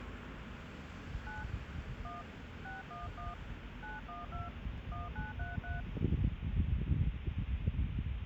DTMF, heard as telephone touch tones, dialled by hand, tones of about 170 ms, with phone line noise and street noise. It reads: 9 1 611 912 1933